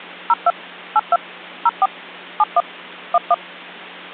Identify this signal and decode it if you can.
DTMF, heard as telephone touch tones, dialled by machine, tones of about 40 ms, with hum. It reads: 02 82 04 71 11